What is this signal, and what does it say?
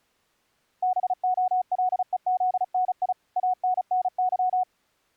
Morse code (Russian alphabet), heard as a keyed tone, machine-sent, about 35 wpm, 740 Hz. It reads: БОЛЕЗНИ АННЫ